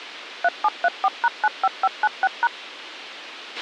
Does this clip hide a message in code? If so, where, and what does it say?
Yes: DTMF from 0.4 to 2.5 s, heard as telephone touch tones, dialled by machine, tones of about 40 ms, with a squelch burst at the end. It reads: 3734#95596#